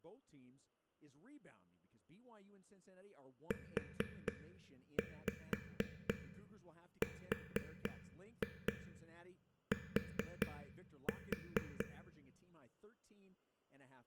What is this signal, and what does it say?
Tap code, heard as taps on a table, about 4 knocks a second, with room echo and speech in English. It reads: URT